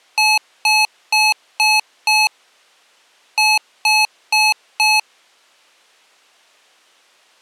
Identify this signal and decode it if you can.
Beep code, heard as beeps from a small speaker, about 860 Hz. 5-4.